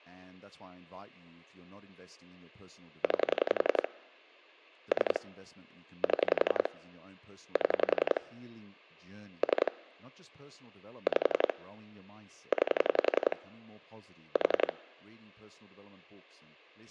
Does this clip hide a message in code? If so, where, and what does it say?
Yes: pulse dialling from 3.0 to 14.7 s, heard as clicks on a phone line, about 11 pulses a second, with speech in English. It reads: 9 3 7 7 3 5 9 4